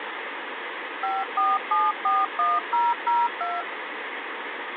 DTMF, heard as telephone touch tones, dialled by machine, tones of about 200 ms, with phone line noise. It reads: 54741002